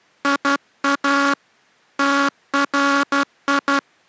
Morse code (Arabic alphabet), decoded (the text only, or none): يا تري